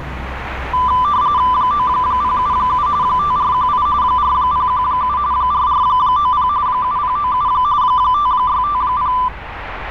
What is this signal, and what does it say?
RTTY (45.45 baud, 170 Hz shift), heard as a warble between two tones, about 1090 Hz centre, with radio static and street noise. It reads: 9077 5418 4017 4490 7097 5650